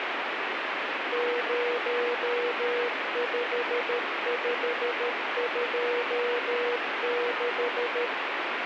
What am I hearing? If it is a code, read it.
Morse code, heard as a keyed tone, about 13 wpm, 480 Hz, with radio static. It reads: 05526